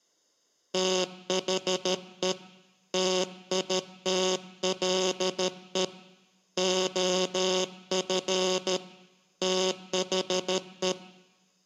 Morse code, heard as a buzzer, hand-sent with a paddle, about 13 wpm. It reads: THE TITLE OF THE